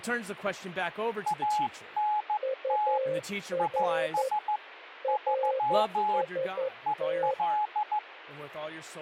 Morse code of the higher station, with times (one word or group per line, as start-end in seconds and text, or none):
1.3-3.0 ANT
3.6-4.6 IS
5.1-6.2 3
6.9-8.0 EL